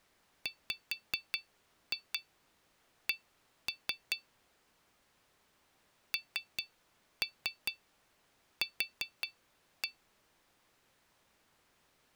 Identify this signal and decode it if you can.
Tap code, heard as taps on glass, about 4 knocks a second. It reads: WC NQ